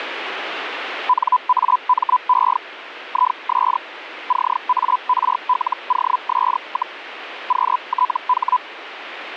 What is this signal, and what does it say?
Hellschreiber (Feld-Hell, 122.5 baud), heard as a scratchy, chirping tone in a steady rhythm, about 1000 Hz, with radio static. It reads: NAME IS CARLOS, QTH